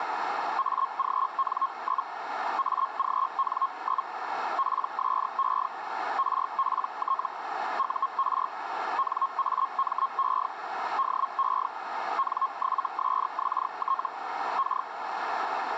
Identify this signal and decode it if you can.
Hellschreiber (Feld-Hell, 122.5 baud), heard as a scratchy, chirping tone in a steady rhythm, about 1080 Hz, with radio static and a narrow filter. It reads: AGN? AGN? PSE RPT UR NAME DE N7SXT K